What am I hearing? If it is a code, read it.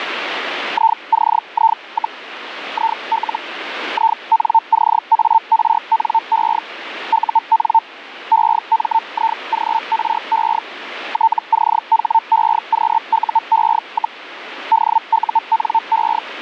Hellschreiber (Feld-Hell, 122.5 baud), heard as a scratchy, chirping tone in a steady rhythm, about 900 Hz, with radio static. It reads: ICI, IL INCARNE UN EMIGRE TCHEQUE, DUNE